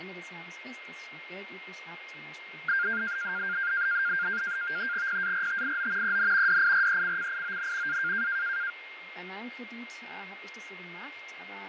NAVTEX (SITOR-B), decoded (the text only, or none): PARTIO EN DIRECCION A